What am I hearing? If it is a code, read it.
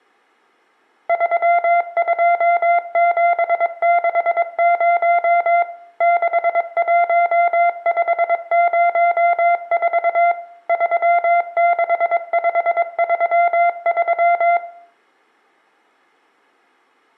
Morse code, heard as a keyed tone, machine-sent, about 22 wpm, 690 Hz, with room echo. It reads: 32760 61504 36533